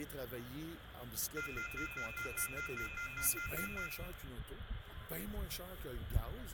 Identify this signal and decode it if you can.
Telephone call progress tone (North American plan), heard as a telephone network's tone, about 1400, 2050, 2450, 2600 Hz, 0.1 s on and 0.1 s off, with phone line noise and room echo. Off-hook warning tone.